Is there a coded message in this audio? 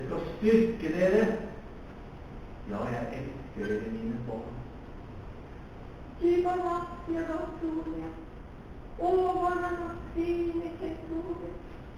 No.